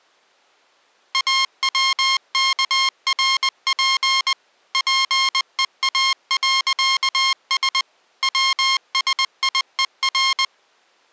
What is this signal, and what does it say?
Morse code, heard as electronic beeps, machine-sent, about 20 wpm, 1070 Hz. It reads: AWKRP PEA.S WSIER